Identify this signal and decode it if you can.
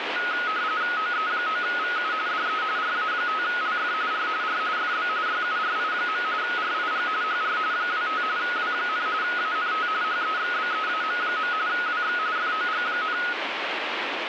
RTTY (45.45 baud, 170 Hz shift), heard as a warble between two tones, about 1360 Hz centre, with radio static. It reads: OE9VU DE RA5LF R R FB YURI. RIG HR 25 W, ANT HEXBEAM. WX FOG,